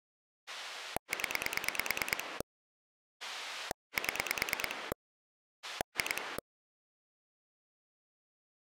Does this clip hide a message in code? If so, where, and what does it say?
Yes: pulse dialling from 0.5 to 6.4 s, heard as a rotary dial, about 9 pulses a second. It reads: 0 7 2